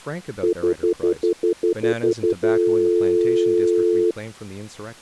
Telephone call progress tone (North American plan), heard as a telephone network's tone, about 350, 440 Hz, 0.1 s on and 0.1 s off, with speech in English. Stutter dial tone.